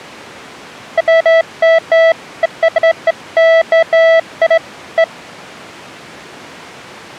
Beeps of irregular length. There is no code.